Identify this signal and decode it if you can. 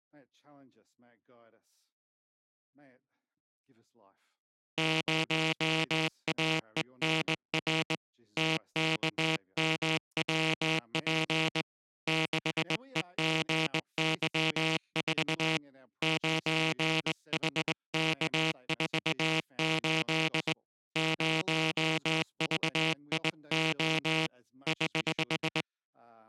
Morse code, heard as a buzzer, hand-sent with a straight key, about 20 wpm. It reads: 0AENR TKMWP 6EGY4 9HK48 0VIO <HH>